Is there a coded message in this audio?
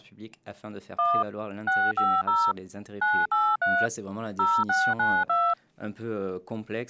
Yes: DTMF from 1.0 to 5.5 s, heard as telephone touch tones, dialled by machine, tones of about 240 ms. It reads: 1 650 983 0692